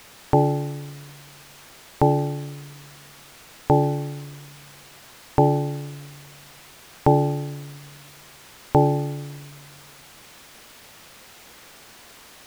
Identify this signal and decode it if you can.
Clock strike, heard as a bell. 6. Six o'clock.